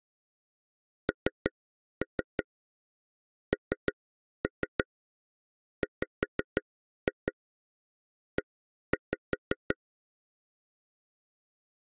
Tap code, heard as taps on a table, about 5 knocks a second. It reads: NNWE